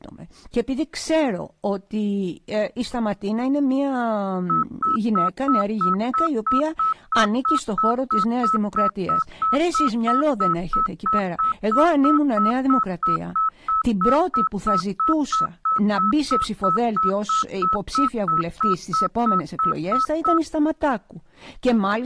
Evenly repeated beeps, with speech in Greek. There is no code.